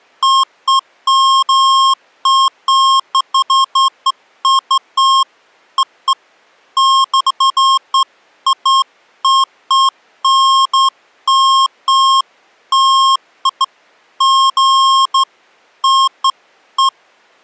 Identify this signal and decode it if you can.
Beeps of irregular length. There is no code.